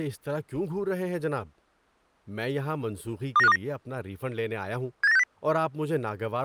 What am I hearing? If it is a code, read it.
Five-tone selective call (EEA), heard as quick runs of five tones, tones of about 40 ms, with speech in Urdu. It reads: 29529 78960